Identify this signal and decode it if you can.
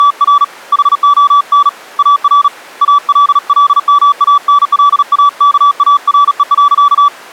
Morse code, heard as a keyed tone, hand-sent with a paddle, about 37 wpm, 1150 Hz. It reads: … HON AR ALLMANLAKARE.